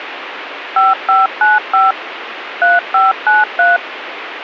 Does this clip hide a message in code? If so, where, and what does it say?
Yes: DTMF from 0.8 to 3.8 s, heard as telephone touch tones, dialled by machine, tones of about 170 ms, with radio hiss. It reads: 5595 3593